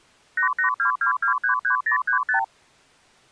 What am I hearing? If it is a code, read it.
Multi-frequency trunk signalling (R2, with the far end's replies), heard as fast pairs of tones, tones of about 110 ms. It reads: 8822233035